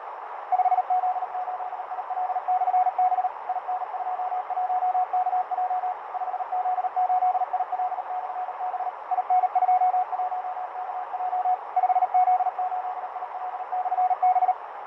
Morse code, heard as a keyed tone, machine-sent, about 38 wpm, 730 Hz, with heavy radio static, fading and a narrow filter. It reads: 5Z8IL/B IN21KJ 5Z8IL/B IN21KJ 5Z8IL/B